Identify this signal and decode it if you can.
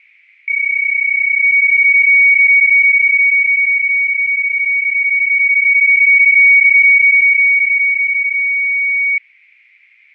PSK31 (31.25 baud), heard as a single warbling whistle, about 2250 Hz, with fading.